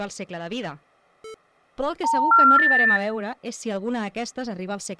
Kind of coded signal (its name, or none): telephone call progress tone